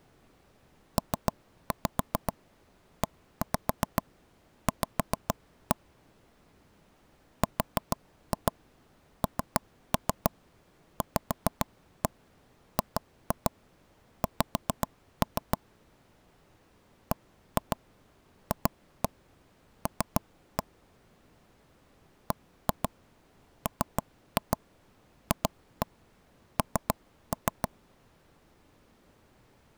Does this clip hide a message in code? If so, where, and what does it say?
Yes: tap code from 1.0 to 27.7 s, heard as taps on a table, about 7 knocks a second. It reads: PEV RNVGX BFL BMFN